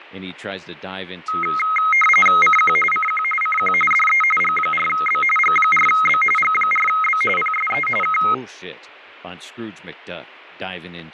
RTTY (45.45 baud, 850 Hz shift), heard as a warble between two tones, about 1700 Hz centre, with fading and speech in English. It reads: CQ CQ CQ DE G4B G4B G4B PSE K